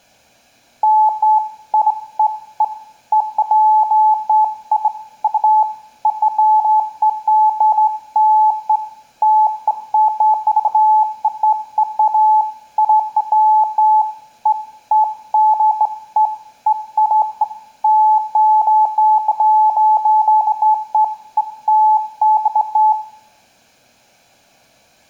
Beeps of irregular length, with room echo. There is no code.